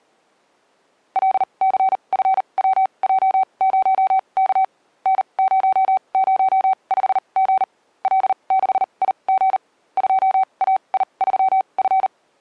Morse code, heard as a keyed tone, machine-sent, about 39 wpm, spaced as for 29 wpm, 760 Hz. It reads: LCFWJ0K N005G L6IG 2AI3F